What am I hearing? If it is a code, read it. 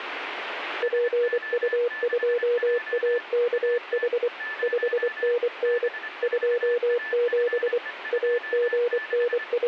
Morse code, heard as a keyed tone, machine-sent, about 24 wpm, 480 Hz, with radio static and a weaker station near 1750 Hz. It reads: PU2AKH 5NN 27 …